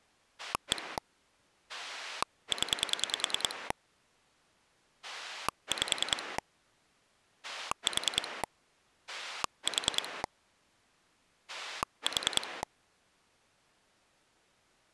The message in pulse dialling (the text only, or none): 1 0 5 4 4 4